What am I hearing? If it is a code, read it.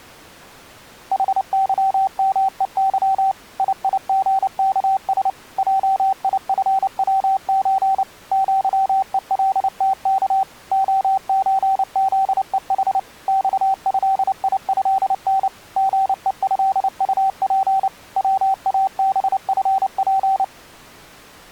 Morse code (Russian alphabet), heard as a keyed tone, machine-sent, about 29 wpm, 770 Hz. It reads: ХЫМЕЫ ИИГКС ЙИФВЧ ЪЕЛТК ОЧЗЕХ ЬЭИЭН ГЕЭУП ВАБФП